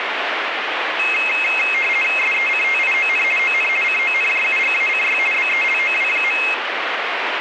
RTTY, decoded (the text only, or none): SECTION ON CONJUGACY BELOW.